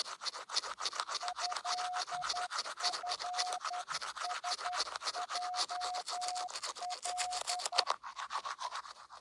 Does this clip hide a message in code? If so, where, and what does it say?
Yes: Morse code (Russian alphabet) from 1.2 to 7.9 s, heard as a keyed tone, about 11 wpm, 730 Hz, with the noise of a restroom. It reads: ЭФСЙЛ